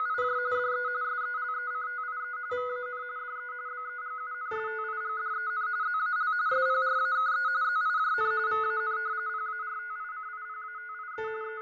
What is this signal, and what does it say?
RTTY (45.45 baud, 170 Hz shift), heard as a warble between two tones, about 1360 Hz centre, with fading and a steady whistle near 2050 Hz. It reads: … DE SELECTIE VAN DE BEGUNSTIGDEN ZAL SPRAKE ZIJN VAN PARTICIPATIE …